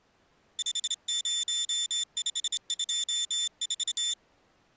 Morse code, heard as a high beeper, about 27 wpm, 3550 Hz. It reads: 50524